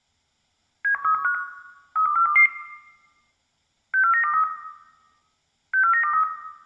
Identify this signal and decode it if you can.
Five-tone selective call (CCIR), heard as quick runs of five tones, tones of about 100 ms, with room echo. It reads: 71315 32422 64923 64923